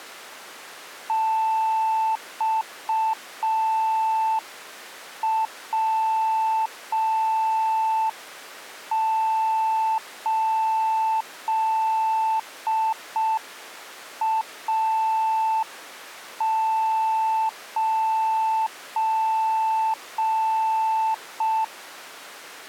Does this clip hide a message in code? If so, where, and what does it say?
Yes: Morse code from 1.0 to 21.7 s, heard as a keyed tone, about 5 wpm, 880 Hz. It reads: XW8A9